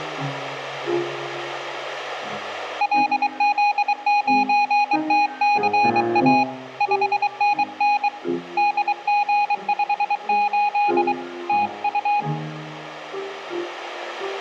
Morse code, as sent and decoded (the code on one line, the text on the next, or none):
.-.. --.. ----. - -.-. .- / ..... -. -. / -.. --. ..... ---.. / - ..-
LZ9TCA 5NN DG58 TU